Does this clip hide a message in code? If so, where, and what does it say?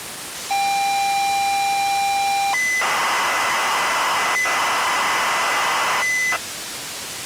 Yes: ZX Spectrum tape loading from 0.5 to 6.4 s, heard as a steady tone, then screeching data, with tape hiss.